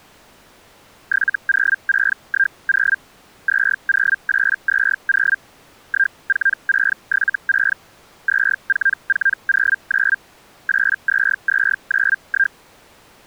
Hellschreiber (Feld-Hell, 122.5 baud), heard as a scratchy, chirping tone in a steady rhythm, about 1600 Hz. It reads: 70610 20820 14676 24409 82291